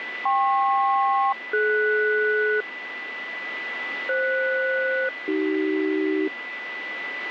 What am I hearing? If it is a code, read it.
Aircraft SELCAL, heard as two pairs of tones, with radio static and a steady whistle near 1990 Hz. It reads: KP-DS FS-AC